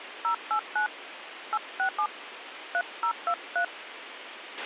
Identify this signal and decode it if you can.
DTMF, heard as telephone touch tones, dialled by hand, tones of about 80 ms, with radio hiss and a squelch burst at the end. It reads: 089 867 3023